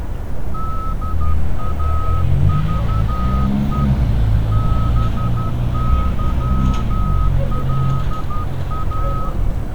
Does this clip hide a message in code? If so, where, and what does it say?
Yes: Morse code (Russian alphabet) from 0.5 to 9.4 s, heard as a whistle, hand-sent with a straight key, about 12 wpm, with street noise. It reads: ДАЖЕ БЫЛА